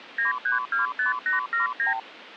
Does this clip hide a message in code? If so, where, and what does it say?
Yes: multi-frequency trunk signalling (R2, with the far end's replies) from 0.2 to 2.0 s, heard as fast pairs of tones, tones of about 140 ms. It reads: 9325879